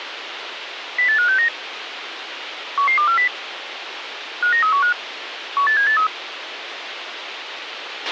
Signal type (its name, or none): five-tone selective call